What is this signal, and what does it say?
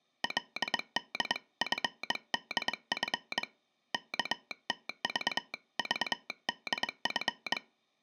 Morse code (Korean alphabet), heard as a telegraph sounder, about 22 wpm. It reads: 그는 얼른